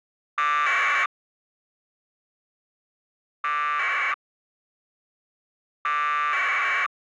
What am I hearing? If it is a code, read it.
Packet radio (AX.25, as in APRS), 1200 baud, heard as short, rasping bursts.